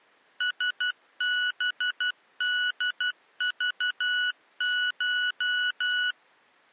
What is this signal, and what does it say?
Morse code (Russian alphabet), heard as electronic beeps, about 12 wpm, 1470 Hz. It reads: СБДЖШ